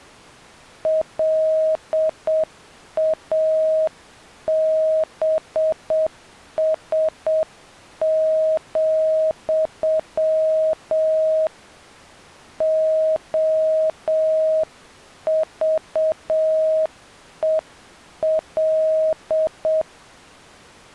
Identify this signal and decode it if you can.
Morse code, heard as a keyed tone, hand-sent with a paddle, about 7 wpm, 630 Hz. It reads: LABS, OVEL